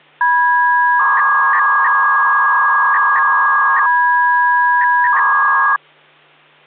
300-baud modem data (V.21 tones), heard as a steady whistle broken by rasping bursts, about 300 baud, 200 Hz shift, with hum.